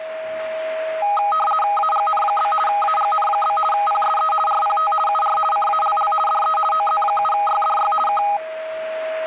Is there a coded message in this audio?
Yes: RTTY (50 baud, 450 Hz shift) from 1.0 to 8.4 s, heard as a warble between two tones, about 1040 Hz centre, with a steady whistle near 640 Hz and the noise of a restroom. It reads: AGN? AGN? PSE RPT UR CALL DE OZ7YDY K